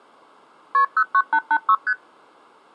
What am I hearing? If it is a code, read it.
Multi-frequency trunk signalling (R1, as on North American trunks), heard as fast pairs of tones, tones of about 60 ms. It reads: KP 09886 ST